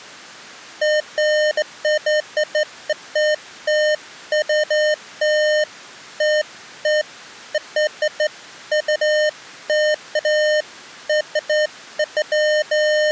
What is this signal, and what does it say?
Beeps of irregular length. There is no code.